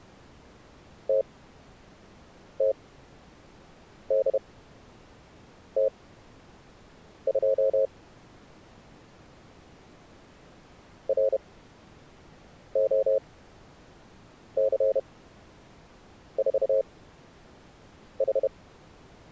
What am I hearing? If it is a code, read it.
Morse code, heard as a keyed tone, machine-sent, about 31 wpm, spaced as for 6 wpm, 540 Hz. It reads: TTDT2 ROC4H